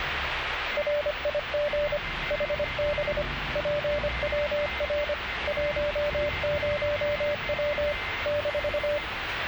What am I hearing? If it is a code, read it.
Morse code, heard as a keyed tone, machine-sent, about 25 wpm, 590 Hz, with radio static, a weaker station near 2080 Hz and the noise inside a bus. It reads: RIG HB PWR 10W -